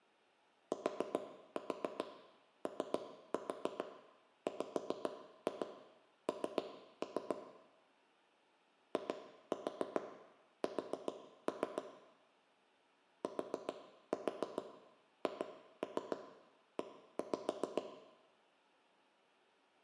Tap code, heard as knocks on wood, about 7 knocks a second, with room echo. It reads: TOWN IS THE